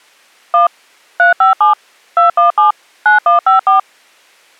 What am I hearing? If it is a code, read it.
DTMF, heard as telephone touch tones, dialled by machine, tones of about 130 ms. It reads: 1 357 217 9154